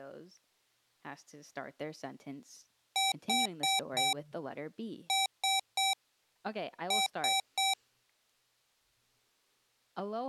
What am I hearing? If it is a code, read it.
Beep code, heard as beeps from a small speaker, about 770 Hz, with speech in English. 4-3-3. In Phoenix BIOS tables: timer channel 2 failure.